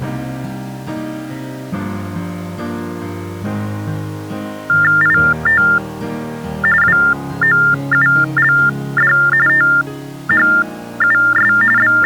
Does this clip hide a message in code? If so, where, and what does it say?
Yes: TTY/TDD text telephone tones (45.45 baud Baudot) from 4.7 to 12.1 s, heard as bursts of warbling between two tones, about 400 Hz shift, 1600 Hz centre. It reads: IT WOULD THUS …